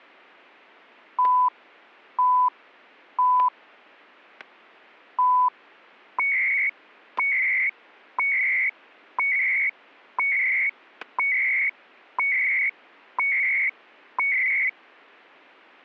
Radio time signal (CHU, Canada), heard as beeps and data bursts, one a second, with static crashes.